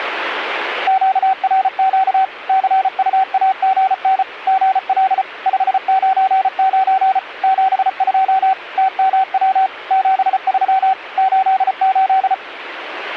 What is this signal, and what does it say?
Morse code, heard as a keyed tone, machine-sent, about 34 wpm, 760 Hz. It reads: QRQ CUAGN GL 599 72 TMW 73 88